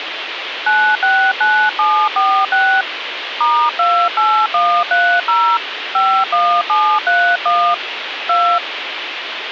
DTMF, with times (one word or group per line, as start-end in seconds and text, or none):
0.7-2.8 969746
3.4-5.6 *28130
5.9-7.7 51731
8.3-8.6 2